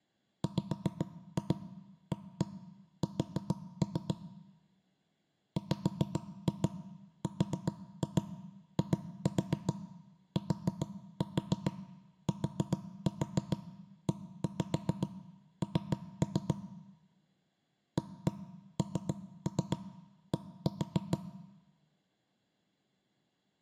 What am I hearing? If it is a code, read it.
Tap code, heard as knocks on wood, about 7 knocks a second, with room echo. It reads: WAS WRITTEN AND